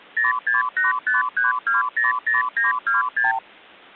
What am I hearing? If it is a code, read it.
Multi-frequency trunk signalling (R2, with the far end's replies), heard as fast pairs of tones, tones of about 150 ms. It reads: 06853200926